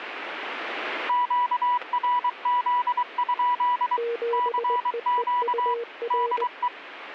Morse code, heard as two keyed tones. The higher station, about 23 wpm, 980 Hz: QRZ? CQ DE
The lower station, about 20 wpm, 470 Hz: 7EEUR